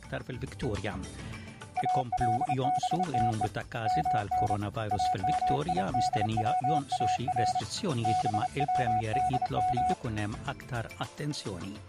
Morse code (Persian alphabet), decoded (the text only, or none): البته من امیدوار بودم